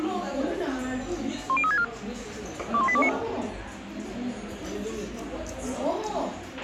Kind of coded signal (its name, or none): five-tone selective call